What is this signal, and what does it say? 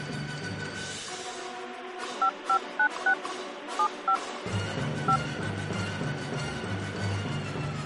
DTMF, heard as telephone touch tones, dialled by hand, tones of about 80 ms. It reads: 5596 75 5